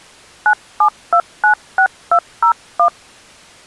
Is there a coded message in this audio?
Yes: DTMF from 0.5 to 2.9 s, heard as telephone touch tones, dialled by hand, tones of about 90 ms. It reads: 97296201